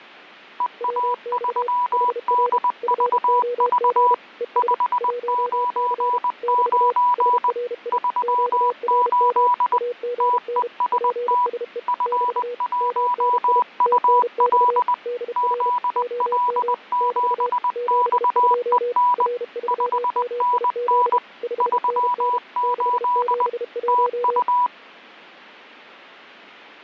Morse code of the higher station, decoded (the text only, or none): EA3DVV 599 38 TEST F1UL ZL7XEN 5NN 38 TU